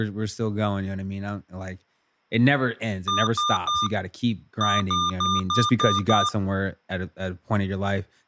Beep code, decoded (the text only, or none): 3-6